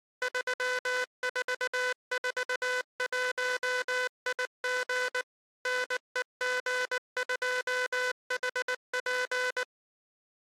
Morse code, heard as a buzzer, machine-sent, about 19 wpm. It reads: 3441IG NEG2HP